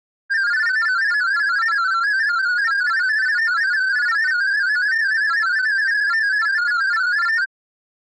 Multi-tone FSK (Olivia or MFSK type), about 500 Hz wide, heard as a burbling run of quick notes, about 31.25 baud.